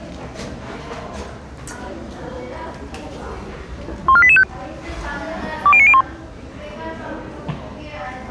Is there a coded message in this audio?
Yes: five-tone selective call (ZVEI) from 4.1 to 6.0 s, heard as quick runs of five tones, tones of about 70 ms, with the noise of a crowd indoors. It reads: 14885 20901